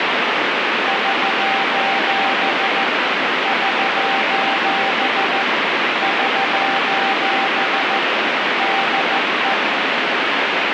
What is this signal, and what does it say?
Morse code, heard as a keyed tone, machine-sent, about 14 wpm, 780 Hz, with heavy radio static. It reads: <SOS> <SOS> <SOS> DE